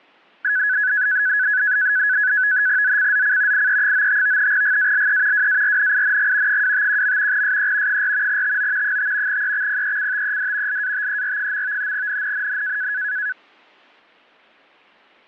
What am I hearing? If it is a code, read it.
NAVTEX (SITOR-B), 100 baud, 170 Hz shift, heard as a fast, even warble, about 1600 Hz centre. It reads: ZCZC IE95 GALE WARNING 251. SE 4 TO 5 EXPECTED LATER. NNNN